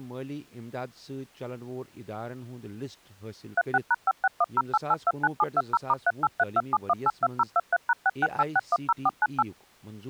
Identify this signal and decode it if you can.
DTMF, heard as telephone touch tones, dialled by machine, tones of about 40 ms, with speech in Kashmiri. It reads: 36#56108829720*38327182023#668610498